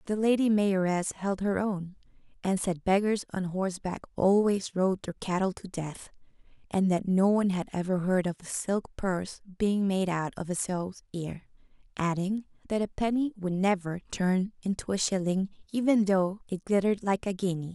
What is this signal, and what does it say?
Speech in English. There is no code.